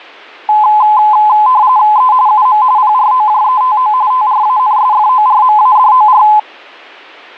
RTTY (45.45 baud, 170 Hz shift), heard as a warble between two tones, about 940 Hz centre. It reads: E UM PROJETO TRANSFORMADOR